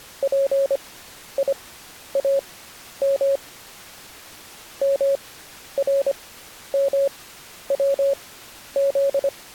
Morse code (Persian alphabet), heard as a keyed tone, machine-sent, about 25 wpm, spaced as for 11 wpm, 550 Hz. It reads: پیام مرموز